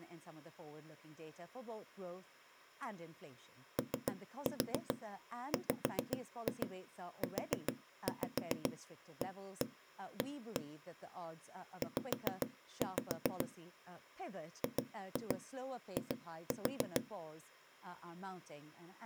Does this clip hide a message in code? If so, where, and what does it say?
Yes: tap code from 3.8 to 17.0 s, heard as knocks on a wall, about 7 knocks a second, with speech in English. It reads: OWUAA Z GI